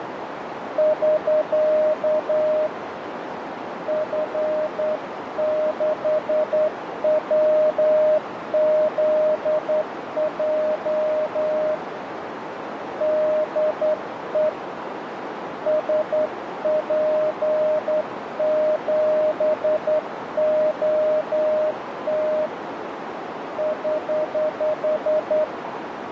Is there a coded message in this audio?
Yes: Morse code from 0.7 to 25.5 s, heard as a keyed tone, hand-sent with a straight key, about 10 wpm, 620 Hz, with heavy radio static and a narrow filter. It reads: <SK> F6WZJ DE SP7OT <HH>